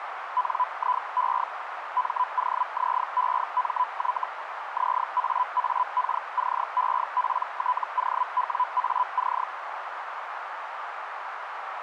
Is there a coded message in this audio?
Yes: Hellschreiber (Feld-Hell, 122.5 baud) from 0.4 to 9.4 s, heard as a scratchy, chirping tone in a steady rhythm, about 1000 Hz, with radio static and a narrow filter. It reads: NIE MOZEMY ZAAKCEPTOWAC